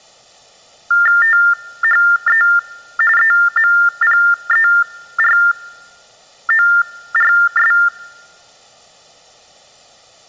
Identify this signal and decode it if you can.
TTY/TDD text telephone tones (45.45 baud Baudot), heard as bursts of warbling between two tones, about 400 Hz shift, 1600 Hz centre. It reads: THE EMPERORS